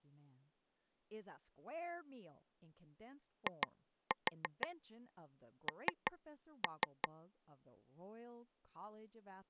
Tap code, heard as taps on a table, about 5 knocks a second, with speech in English. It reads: IN